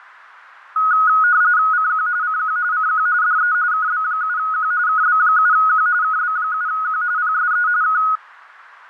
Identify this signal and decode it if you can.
RTTY (45.45 baud, 170 Hz shift), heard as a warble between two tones, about 1360 Hz centre. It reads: CQ CQ CQ DE KB7Q KB7Q KB7Q PSE K